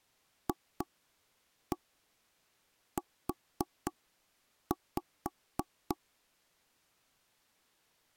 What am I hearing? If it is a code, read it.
Tap code, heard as taps on a table, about 3 knocks a second. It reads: FU